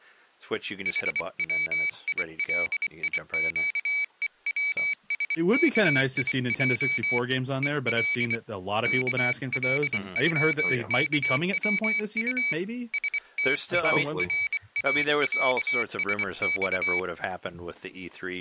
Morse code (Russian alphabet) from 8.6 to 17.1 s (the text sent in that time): КЛЮКВУ СТАРАЯСЬ